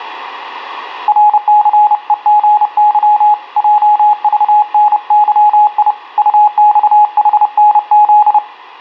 Morse code, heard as a keyed tone, hand-sent with a paddle, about 30 wpm, 840 Hz, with radio static. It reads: RCEGY JVNYI UXHNZ